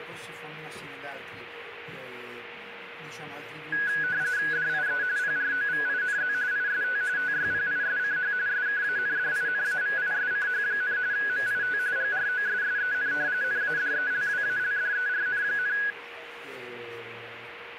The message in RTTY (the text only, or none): DIE PROVINZ IST TYPISCH SKANDINAVISCH, MIT GROSSEN NADELWALDERN,